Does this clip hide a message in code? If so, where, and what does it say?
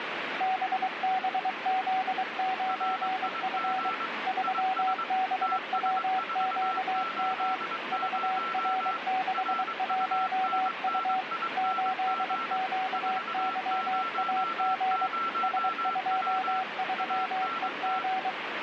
Yes: Morse code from 0.3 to 18.4 s, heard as two keyed tones, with radio static. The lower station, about 23 wpm, 750 Hz: BBZ9F 3BWQM VR61U 8QYAG S23EG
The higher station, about 22 wpm, 1340 Hz: RIG IS TS480 RUNNING 400W ANT